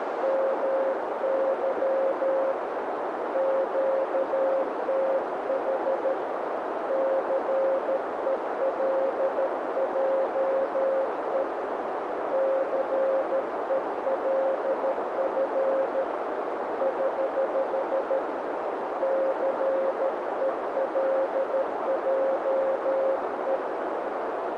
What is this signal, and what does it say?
Morse code, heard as a keyed tone, hand-sent with a paddle, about 13 wpm, 540 Hz, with heavy radio static and a narrow filter. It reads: MY QTH CELJE CELF <HH> CELJE